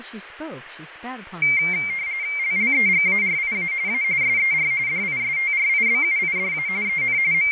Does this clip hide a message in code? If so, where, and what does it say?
Yes: RTTY (45.45 baud, 170 Hz shift) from 1.4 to 7.5 s, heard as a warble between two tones, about 2200 Hz centre, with radio static, fading and speech in English. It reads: LLEGARIA A SER DISTRIBUIDA EN …